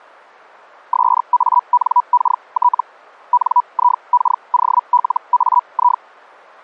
Hellschreiber (Feld-Hell, 122.5 baud), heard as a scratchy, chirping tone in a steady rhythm, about 980 Hz. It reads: SANKT NIKOLAI